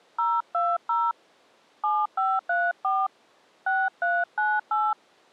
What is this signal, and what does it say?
DTMF, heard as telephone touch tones, dialled by hand, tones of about 220 ms. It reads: 020 7534 6398